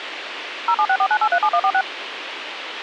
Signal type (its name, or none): DTMF